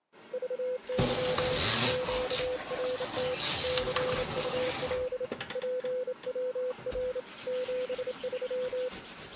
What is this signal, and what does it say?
Morse code, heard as a keyed tone, hand-sent with a straight key, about 28 wpm, 500 Hz, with kitchen noise. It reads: VY QRT CUL PWR 73